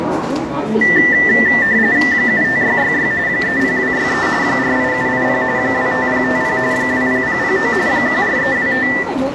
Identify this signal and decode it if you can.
RTTY (45.45 baud, 170 Hz shift), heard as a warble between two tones, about 1900 Hz centre, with radio static, fading, room echo and the noise of a subway station. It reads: 75666 30263 48780 25050 20009 14325